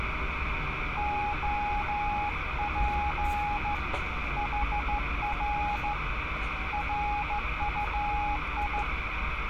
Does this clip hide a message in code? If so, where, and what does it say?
Yes: Morse code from 0.9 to 8.9 s, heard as a keyed tone, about 14 wpm, 830 Hz, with radio static and street noise. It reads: OP HR RUI